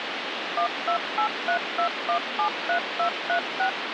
DTMF, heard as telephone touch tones, dialled by machine, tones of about 100 ms, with phone line noise. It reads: 12832173236